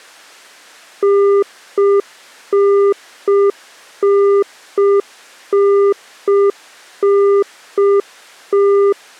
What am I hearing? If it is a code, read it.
Telephone call progress tone (UK plan), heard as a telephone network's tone, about 400 Hz. Congestion tone.